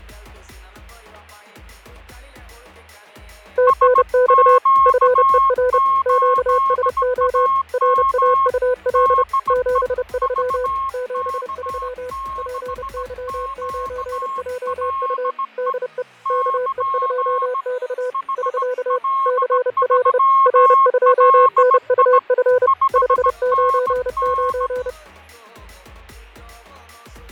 Morse code, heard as two keyed tones, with fading. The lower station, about 30 wpm, 500 Hz: TNX FER QSO RAUL 73 73 PY9JU DE KE2X <SK> CL R2NUF 599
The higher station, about 17 wpm, 1080 Hz: SQ8AM DE VK6QLE <KN> HL3LI 5NN